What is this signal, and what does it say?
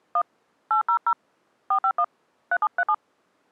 DTMF, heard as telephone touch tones, dialled by hand, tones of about 80 ms. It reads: 1 800 451 3737